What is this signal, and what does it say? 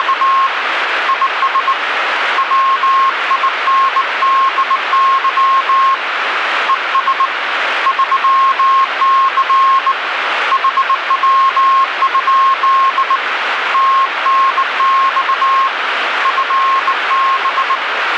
Morse code, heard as a keyed tone, hand-sent with a bug key, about 19 wpm, 1080 Hz, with radio static. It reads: … IS WINDY ES 3C HW? TNX FB